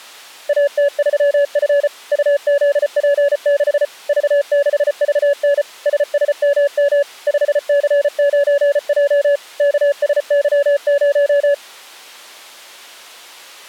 Morse code, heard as a keyed tone, machine-sent, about 34 wpm, 570 Hz. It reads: AT3F UZP6 V6VN SSMM 5C9J KSY0